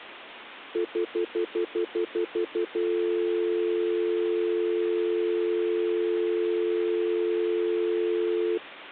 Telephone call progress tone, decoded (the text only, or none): stutter dial tone